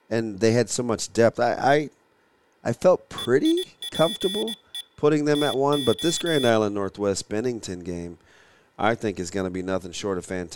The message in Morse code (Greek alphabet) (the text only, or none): ΕΙΠΕ ΤΟ